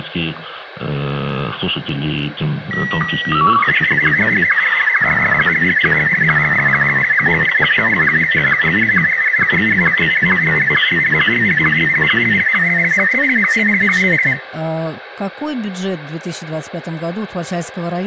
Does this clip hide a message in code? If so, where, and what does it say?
Yes: SSTV (slow-scan television), Martin M1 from 2.7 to 14.3 s, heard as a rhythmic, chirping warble, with radio hiss and room echo.